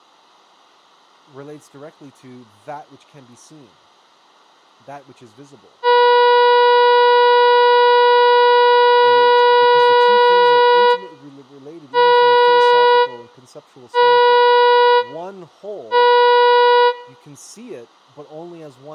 Ship horn signal, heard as a ship's horn, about 490 Hz, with room echo and speech in English. 1 long, 3 short. At sea: a vessel under tow in fog.